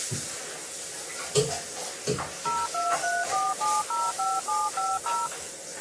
DTMF, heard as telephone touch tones, dialled by machine, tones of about 210 ms, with the noise of a restroom. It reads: 0234705750